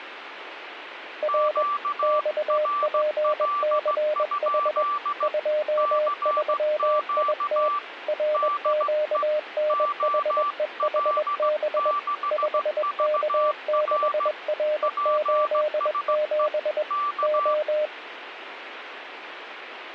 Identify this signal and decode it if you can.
Morse code, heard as two keyed tones, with radio static. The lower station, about 21 wpm, 610 Hz: R XPCH 23IT RQNHEHB 5K6R87 O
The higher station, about 16 wpm, 1170 Hz: QRL? CQ DE OL6VR PSE K